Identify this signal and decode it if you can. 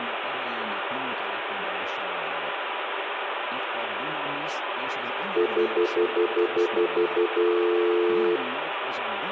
Telephone call progress tone (North American plan), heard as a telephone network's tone, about 350, 440 Hz, 0.1 s on and 0.1 s off, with phone line noise and room echo. Stutter dial tone.